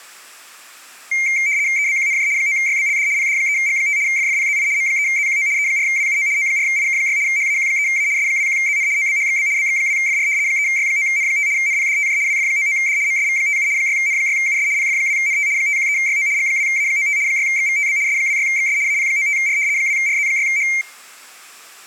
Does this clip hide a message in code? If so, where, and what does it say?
Yes: RTTY (75 baud, 170 Hz shift) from 1.1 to 20.8 s, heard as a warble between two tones, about 2200 Hz centre. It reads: EBQNJ 9YBLD PD3G5 FFPZI M3ZQO E4WUO O4IK6 HAQ3A S21ZN OBHXB BX2FR 3Y9N5 NPDTJ WF99D MSV57 6N6US PF2NT 513YO G2A95 6XVTB S26XS AP95R 2RZ6H